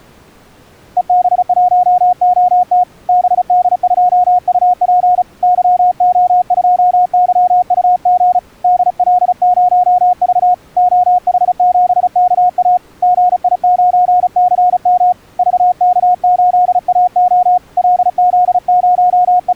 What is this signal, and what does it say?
Morse code, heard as a keyed tone, hand-sent with a paddle, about 35 wpm, 720 Hz. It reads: EB1OT BD2UP YO2YUG DL0V OH7KA GI9CM VK8AO …